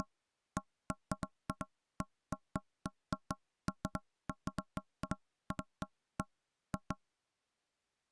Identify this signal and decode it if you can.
Irregular knocks on wood. There is no code.